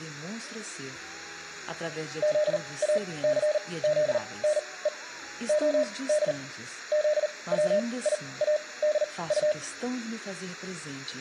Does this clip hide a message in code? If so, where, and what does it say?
Yes: Morse code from 2.2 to 9.6 s, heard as a keyed tone, machine-sent, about 39 wpm, spaced as for 23 wpm, 600 Hz. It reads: ZACZNE OD ZWIADU